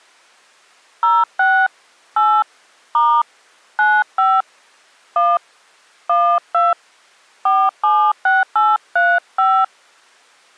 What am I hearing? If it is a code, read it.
DTMF, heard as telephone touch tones, dialled by hand, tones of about 230 ms. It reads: 06 8 * 95 1 12 476835